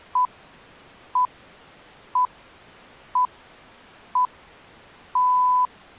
Radio time signal (six pips, as the Greenwich Time Signal), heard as pips.